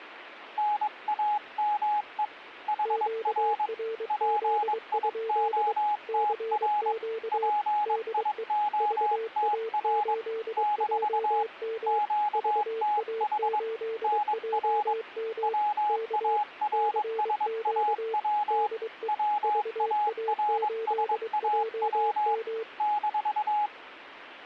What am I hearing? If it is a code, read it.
Morse code, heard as two keyed tones. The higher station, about 22 wpm, 840 Hz: NAME HR PIOTR PIOTR - QTH NR WARSAW WARSAW -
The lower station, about 23 wpm, 450 Hz: QRZ? CQ DE VA8JM VA8JM K CQ DE VA8JM